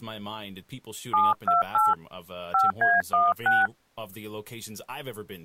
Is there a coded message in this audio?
Yes: DTMF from 1.1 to 3.7 s, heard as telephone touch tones, dialled by hand, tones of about 170 ms, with speech in English. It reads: 728 5A16